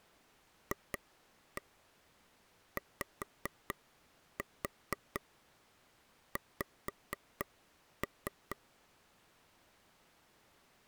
Tap code, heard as taps on a table, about 4 knocks a second. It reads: FYX